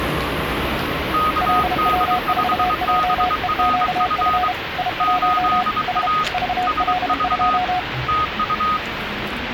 Morse code, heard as two keyed tones, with radio static and the noise of a subway station. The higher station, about 23 wpm, 1250 Hz: KD5BRF 8A SV TU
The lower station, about 32 wpm, 730 Hz: LW4JEQF I1 S VL2